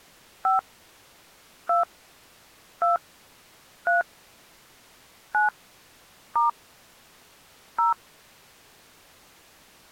DTMF, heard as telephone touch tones, dialled by hand, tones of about 140 ms. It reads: 5 2 2 3 9 * 0